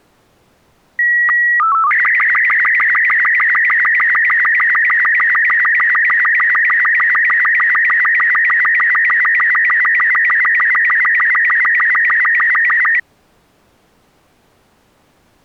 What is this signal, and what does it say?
SSTV (slow-scan television), Robot 36, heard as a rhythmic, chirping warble.